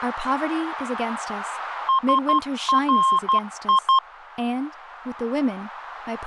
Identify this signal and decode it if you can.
Morse code, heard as a keyed tone, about 12 wpm, 1060 Hz, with radio static and speech in English. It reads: SRI